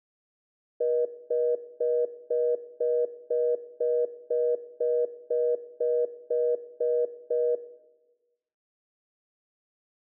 Telephone call progress tone (North American plan), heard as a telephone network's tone, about 480, 620 Hz, 0.25 s on and 0.25 s off, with room echo. Congestion tone.